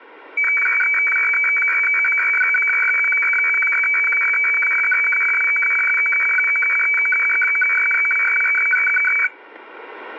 Weather fax (radiofax), 120 lines a minute, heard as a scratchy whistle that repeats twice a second, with static crashes.